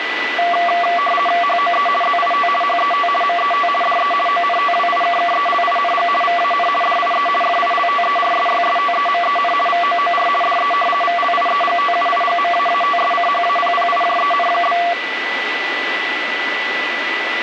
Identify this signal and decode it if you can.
RTTY (50 baud, 450 Hz shift), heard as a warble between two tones, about 920 Hz centre, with radio static and a steady whistle near 1980 Hz. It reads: HOE ZIT HET MET DE ONTWIKKELING VAN DIE FILTERSYSTEMEN VOOR DE VLIEGTUIGMAATSCHAPPIJEN?